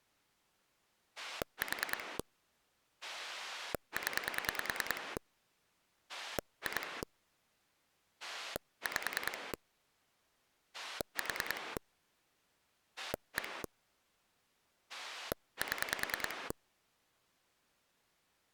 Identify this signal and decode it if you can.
Pulse dialling, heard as a rotary dial, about 10 pulses a second. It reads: 4 0 2 5 4 1 7